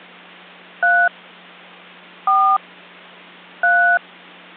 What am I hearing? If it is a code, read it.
DTMF, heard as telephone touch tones, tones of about 290 ms, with hum. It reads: 3 4 3